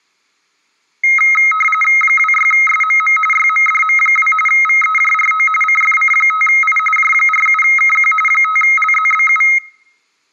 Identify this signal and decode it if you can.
RTTY (45.45 baud, 850 Hz shift), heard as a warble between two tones, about 1700 Hz centre. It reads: 26SMM YMDM2 VEJRO CFC5I J47KQ 5LZBU